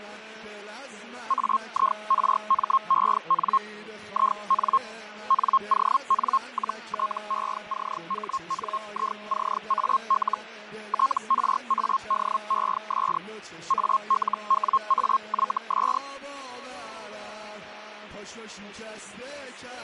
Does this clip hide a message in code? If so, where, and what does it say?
Yes: Hellschreiber (Feld-Hell, 122.5 baud) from 1.3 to 16.0 s, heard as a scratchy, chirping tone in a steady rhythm, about 1070 Hz, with radio static and fading. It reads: AIRMEN IN NON-TECHNICAL TRADES ALWAYS